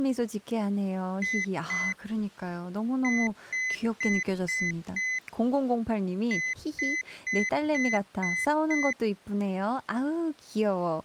Beep code, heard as a piezo beeper, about 2050 Hz, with speech in Korean. 2-5-6.